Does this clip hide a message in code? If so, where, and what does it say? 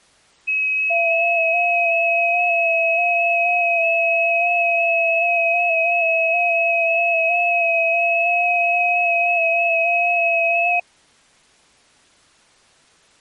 Yes: FT8 (several signals at once) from 0.5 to 10.8 s, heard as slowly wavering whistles, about 6.25 baud.